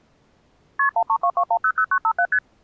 Multi-frequency trunk signalling (R1, as on North American trunks), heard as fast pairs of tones, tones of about 70 ms. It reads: KP 1322100957 ST